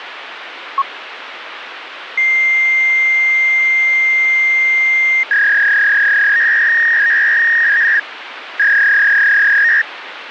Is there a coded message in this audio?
Yes: fax machine handshake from 0.8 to 9.8 s, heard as a long tone and a warble, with phone line noise.